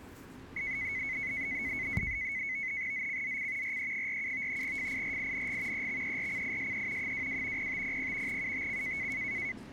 NAVTEX (SITOR-B), 100 baud, 170 Hz shift, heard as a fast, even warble, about 2100 Hz centre, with the noise of a subway station. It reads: ZCZC RE47 FIRING EXERCISE 22 0500 UTC